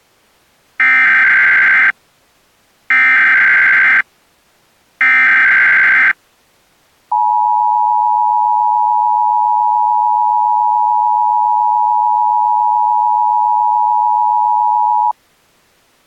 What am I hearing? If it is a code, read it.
Emergency Alert System (SAME) tones (header bursts, then the 853 and 960 Hz attention tone), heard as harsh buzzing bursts, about 520.83 baud.